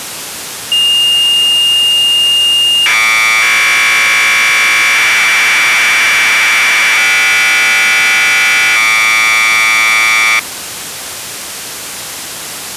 Commodore tape loading (standard loader), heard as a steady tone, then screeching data, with tape hiss.